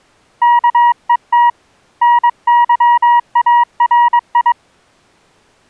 Morse code, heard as a keyed tone, hand-sent with a paddle, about 22 wpm, 960 Hz. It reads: KET NYARI